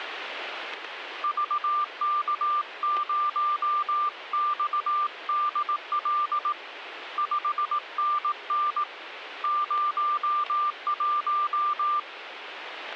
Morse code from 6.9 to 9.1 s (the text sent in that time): 5NN